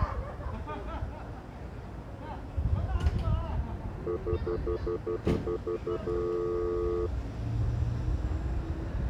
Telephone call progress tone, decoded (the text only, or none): stutter dial tone